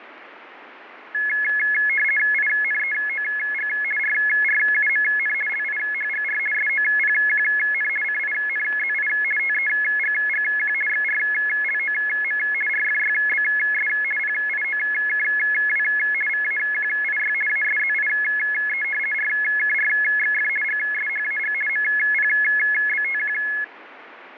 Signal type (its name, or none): RTTY